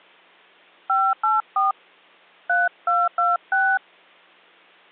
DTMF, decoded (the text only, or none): 584 3226